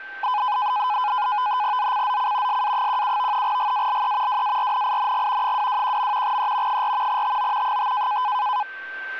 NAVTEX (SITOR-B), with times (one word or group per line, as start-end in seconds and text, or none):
1.8-2.6 ZCZC
2.5-3.4 SA17
3.4-4.4 GALE
4.3-5.5 WARNING
5.4-6.4 221.
6.2-6.8 E
6.7-7.2 4
7.1-7.8 TO
7.6-8.2 5